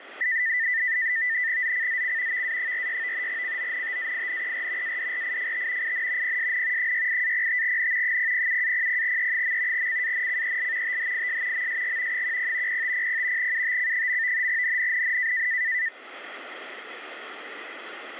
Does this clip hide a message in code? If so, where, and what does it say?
Yes: NAVTEX (SITOR-B), 100 baud, 170 Hz shift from 0.2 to 15.9 s, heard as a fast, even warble, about 1900 Hz centre, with radio static. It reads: ZCZC VA46 CONTAINER ADRIFT IN PSN 68-05N 007-00E. CANCEL THIS MSG 10 0500 UTC. NNNN